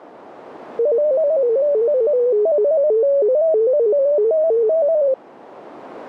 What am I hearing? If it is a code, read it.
Multi-tone FSK (Olivia or MFSK type), about 250 Hz wide, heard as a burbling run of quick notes, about 15.625 baud.